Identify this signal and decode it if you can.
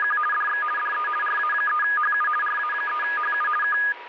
RTTY (50 baud, 450 Hz shift), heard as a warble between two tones, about 1440 Hz centre, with radio static and a steady whistle near 960 Hz. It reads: … DX DE RA3HU RA3HU K